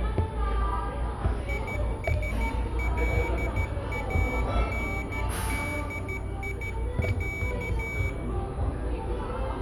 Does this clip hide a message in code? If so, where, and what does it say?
Yes: Morse code (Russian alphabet) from 1.4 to 8.2 s, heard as a high beeper, hand-sent with a paddle, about 13 wpm, 2300 Hz, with room echo and the noise of a cafe. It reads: ИСЛАНДИЯ